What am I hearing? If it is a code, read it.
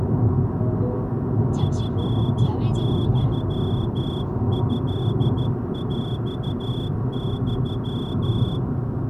Morse code (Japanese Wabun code), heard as a whistle, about 13 wpm, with the noise inside a car. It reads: チユトヰユ